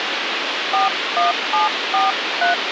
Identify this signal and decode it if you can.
DTMF, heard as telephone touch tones, dialled by hand, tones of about 160 ms, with radio hiss. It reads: 41743